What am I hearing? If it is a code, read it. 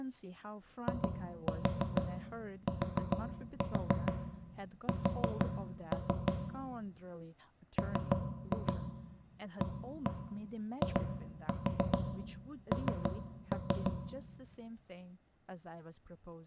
Tap code, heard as knocks on wood, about 6 knocks a second, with room echo and speech in English. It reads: ITS MAIN